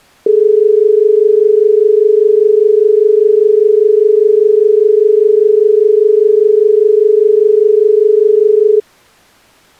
Telephone call progress tone (as in Australia), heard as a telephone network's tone, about 430 Hz. Dial tone.